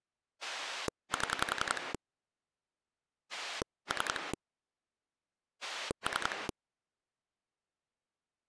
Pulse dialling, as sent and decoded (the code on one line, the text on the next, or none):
7 / 3 / 3
7 3 3